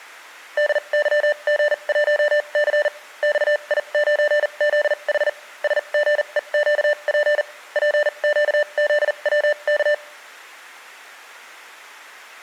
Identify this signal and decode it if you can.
Morse code, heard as electronic beeps, machine-sent, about 40 wpm, spaced as for 32 wpm, 590 Hz. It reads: DYG1C XI9ZH SGEQP PQZWK